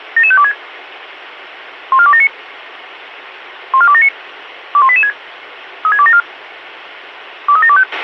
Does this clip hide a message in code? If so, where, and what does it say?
Yes: five-tone selective call (ZVEI) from 0.2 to 7.8 s, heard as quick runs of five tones, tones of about 70 ms, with radio hiss and a squelch burst at the end. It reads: 77526 14279 14279 21886 36274 23725